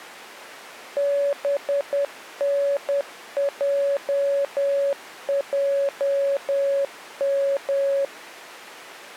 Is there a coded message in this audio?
Yes: Morse code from 0.9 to 8.1 s, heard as a keyed tone, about 10 wpm, 560 Hz. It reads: BNJJM